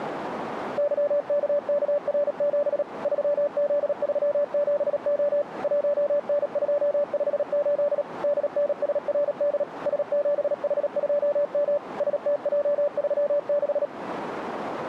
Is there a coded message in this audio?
Yes: Morse code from 0.7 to 13.9 s, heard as a keyed tone, machine-sent, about 37 wpm, 580 Hz, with radio static. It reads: YKKR7 3Z37O 1N258 DNSRD S7H2M STJ36